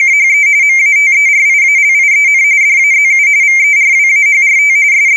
RTTY (45.45 baud, 170 Hz shift), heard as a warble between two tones, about 2200 Hz centre. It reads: … MATERIALIEN DAZU VERWAHRT …